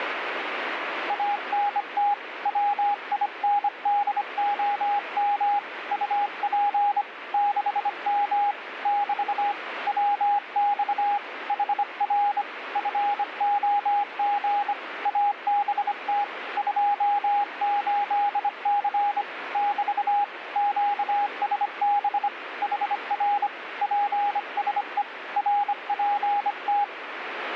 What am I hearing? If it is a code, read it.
Morse code, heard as a keyed tone, hand-sent with a bug key, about 25 wpm, 820 Hz, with radio static. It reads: ANT WINDOM UP 6M <BT> WX HR FOG ABT 28C <BT> QSB HR PSE RPT